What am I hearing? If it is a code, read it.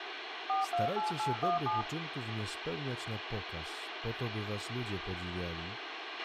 DTMF, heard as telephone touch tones, dialled by machine, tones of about 150 ms, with radio hiss, a squelch burst at the end, room echo and speech in Polish. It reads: 428817